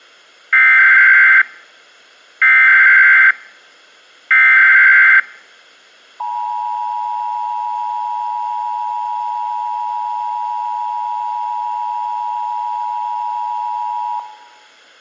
Emergency Alert System (SAME) tones (header bursts, then the 853 and 960 Hz attention tone), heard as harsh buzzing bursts, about 520.83 baud.